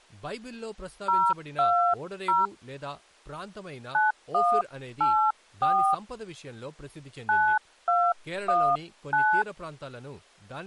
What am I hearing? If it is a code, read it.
DTMF, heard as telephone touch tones, dialled by hand, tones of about 250 ms, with speech in Telugu. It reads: 020 9184 9219